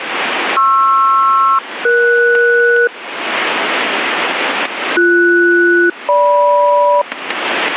Aircraft SELCAL, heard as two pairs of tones, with radio static. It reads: PR-ES BS-GM